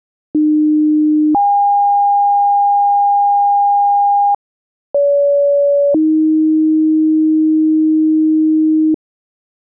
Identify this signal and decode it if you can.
Two-tone page, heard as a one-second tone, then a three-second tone, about 300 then 810 Hz, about 570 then 310 Hz.